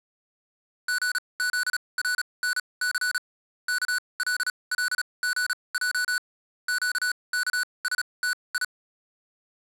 Morse code, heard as electronic beeps, machine-sent, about 36 wpm, spaced as for 25 wpm, 1480 Hz. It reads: GZRNC KLLGJ QKSTI